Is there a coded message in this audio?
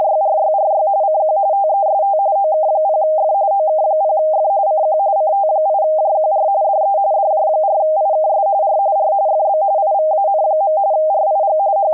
Yes: RTTY (45.45 baud, 170 Hz shift) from 0.0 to 11.9 s, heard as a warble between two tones, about 710 Hz centre. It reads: … CQ TEST OK0F OK0F CQ CT8JQR DE DJ4IKS R R FB IVAN. RIG …